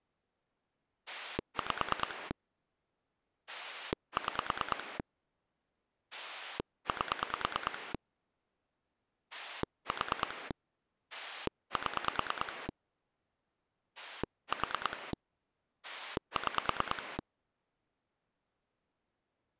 Pulse dialling, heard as a rotary dial, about 9 pulses a second. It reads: 5 6 8 4 7 4 6